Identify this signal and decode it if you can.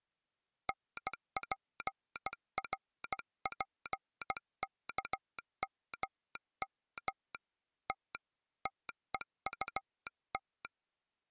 Morse code, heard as a telegraph sounder, hand-sent with a bug key, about 16 wpm. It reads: NPRPKMM T TEUT